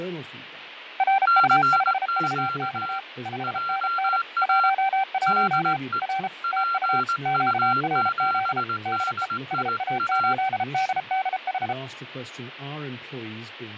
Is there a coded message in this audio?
Yes: Morse code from 0.9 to 11.8 s, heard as two keyed tones, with radio static, fading and speech in English. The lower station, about 33 wpm, 780 Hz: RU5VX 5NN 11 R TU QRZ DE SA8DDH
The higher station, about 19 wpm, 1370 Hz: CQ JA DE PU7DIA